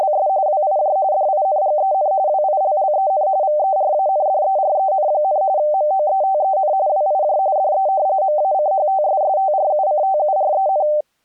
RTTY (45.45 baud, 170 Hz shift), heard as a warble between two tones, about 690 Hz centre. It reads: … WIJ DINGEN WILLEN VERANDEREN, MOETEN WIJ DE MACHTSSTRUCTUREN